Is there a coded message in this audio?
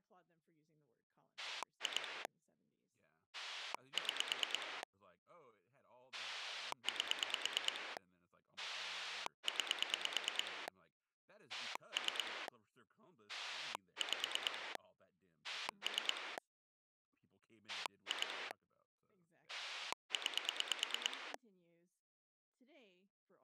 Yes: pulse dialling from 1.4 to 21.4 s, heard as a rotary dial, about 9 pulses a second, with speech in English. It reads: 2 6 8 9 3 5 3 2 9